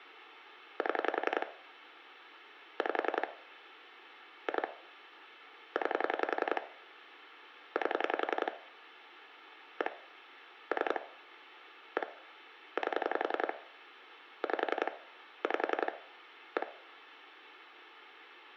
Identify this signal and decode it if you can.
Pulse dialling, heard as clicks on a phone line, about 11 pulses a second, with room echo. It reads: 7 5 2 9 8 1 3 1 8 5 5 1